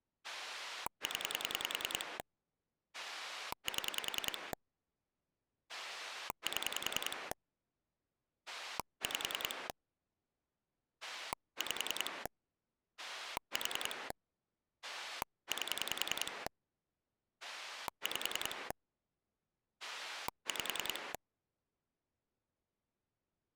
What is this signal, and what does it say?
Pulse dialling, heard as a rotary dial, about 10 pulses a second. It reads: 0 7 7 5 5 4 8 5 5